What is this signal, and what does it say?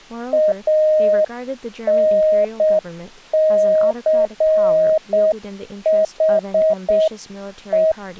Morse code, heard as a keyed tone, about 7 wpm, 630 Hz, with speech in English. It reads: ANCHE